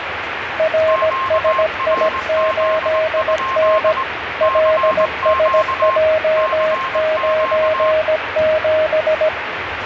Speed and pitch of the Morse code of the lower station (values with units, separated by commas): 17 wpm, 630 Hz